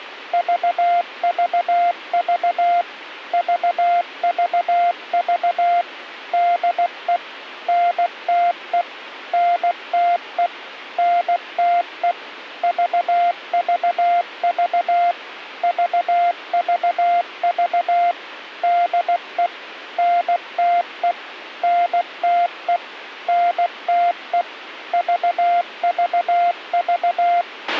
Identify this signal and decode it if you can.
Morse code, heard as a keyed tone, machine-sent, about 16 wpm, 700 Hz, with a squelch burst at the end. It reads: VVV VVV DE NTE NTE NTE VVV VVV DE NTE NTE NTE VVV